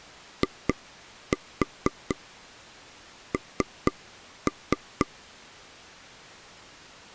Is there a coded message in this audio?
Yes: tap code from 0.4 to 5.1 s, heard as taps on a table, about 4 knocks a second. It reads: IN